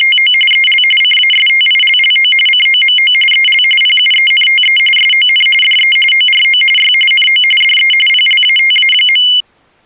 RTTY (45.45 baud, 850 Hz shift), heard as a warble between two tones, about 2550 Hz centre. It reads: … EL CASTILLO COMO EL PUENTE SON DE ORO Y NO DE PLATA.